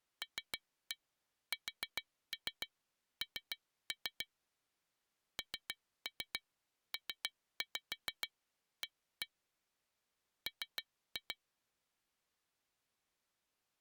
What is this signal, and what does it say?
Tap code, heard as taps on glass, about 7 knocks a second. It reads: LSN NPA M